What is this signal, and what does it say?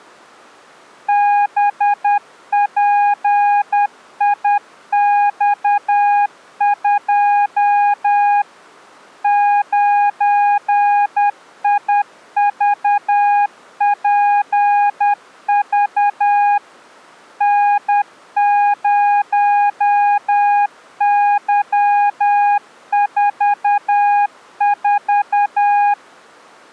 Morse code, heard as a keyed tone, machine-sent, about 10 wpm, 820 Hz. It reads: BPIX2 9IVPV N0Y44